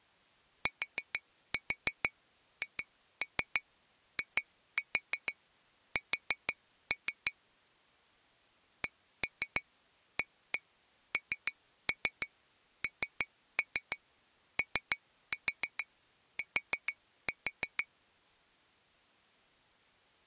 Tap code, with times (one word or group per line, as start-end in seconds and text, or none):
0.7-7.3 THIS
8.8-17.8 CANNOT